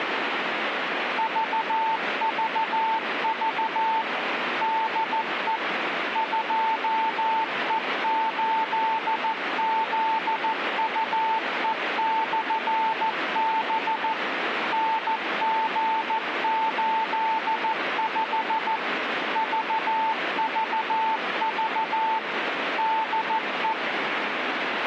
Morse code, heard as a keyed tone, machine-sent, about 14 wpm, 890 Hz, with radio static. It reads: VVV DE 2E8ZUE/B NG85 VVV DE